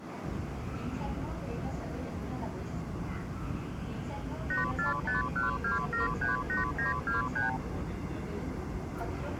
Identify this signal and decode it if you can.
Multi-frequency trunk signalling (R2, with the far end's replies), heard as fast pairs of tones, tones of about 140 ms, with the noise inside a subway train. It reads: 84512738923